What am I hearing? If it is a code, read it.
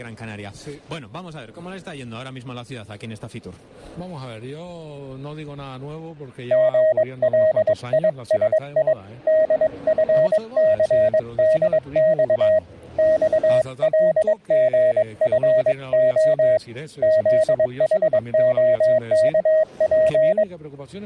Morse code, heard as a keyed tone, hand-sent with a paddle, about 22 wpm, 630 Hz. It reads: GLISI DFCDX XLGFO ZHOKP